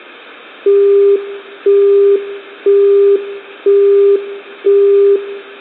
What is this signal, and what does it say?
Telephone call progress tone (single-tone plan, as in Europe, Japan and elsewhere), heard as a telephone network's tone, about 400 Hz, 0.5 s on and 0.5 s off, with room echo. Busy tone.